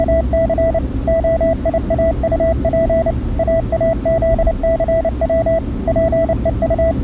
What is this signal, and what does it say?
Morse code, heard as a keyed tone, machine-sent, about 29 wpm, 660 Hz, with the noise inside a car. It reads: … OIAUP AAZCW …